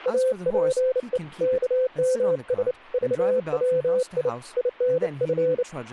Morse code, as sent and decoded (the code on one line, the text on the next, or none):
.- .--. . / -.- -- ... / ...- .-- .. / .. -. ..-.
APE KMS VWI INF